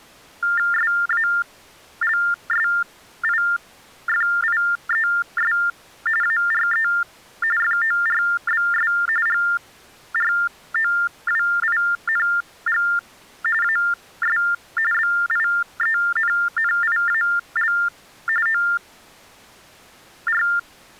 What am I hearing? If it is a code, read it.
TTY/TDD text telephone tones (45.45 baud Baudot), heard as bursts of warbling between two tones, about 400 Hz shift, 1600 Hz centre. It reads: SALSIFIES ARE FORBS GROWING AS BIENNIAL OR